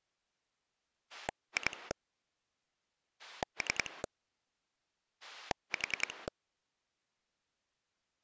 Pulse dialling, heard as a rotary dial, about 10 pulses a second. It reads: 2 3 4